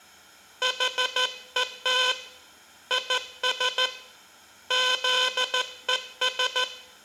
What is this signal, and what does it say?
Morse code, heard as a buzzer, hand-sent with a straight key, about 14 wpm, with room echo. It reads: HET IS ZES